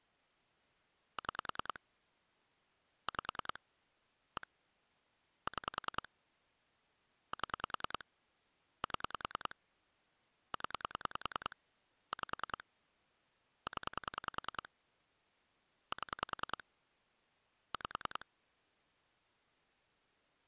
Pulse dialling, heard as clicks on a phone line, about 10 pulses a second. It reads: 6 5 1 6 7 7 0 5 0 7 5